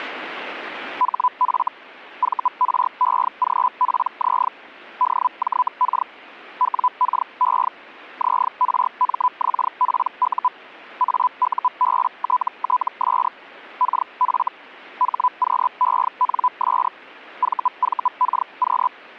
Hellschreiber (Feld-Hell, 122.5 baud), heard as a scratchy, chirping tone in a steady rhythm, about 1000 Hz. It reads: HF VREGPZ DJK WKE ZRMXPU AUBTTS KF HQENS VVKQ